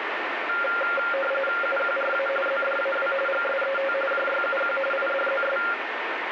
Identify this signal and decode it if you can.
RTTY (45.45 baud, 850 Hz shift), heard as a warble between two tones, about 970 Hz centre, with radio static. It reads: UQRA ZDAW GSET JYUQ IDZS